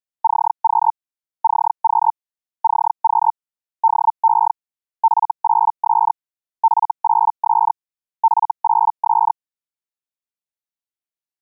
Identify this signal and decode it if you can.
Hellschreiber (Feld-Hell, 122.5 baud), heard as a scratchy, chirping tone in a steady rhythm, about 900 Hz. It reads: CQ CQ CQ DE F8S F8S F8S